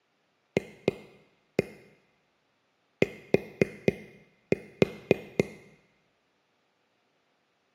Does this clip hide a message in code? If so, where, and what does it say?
Yes: tap code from 0.6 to 5.4 s, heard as taps on a table, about 4 knocks a second, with room echo. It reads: FT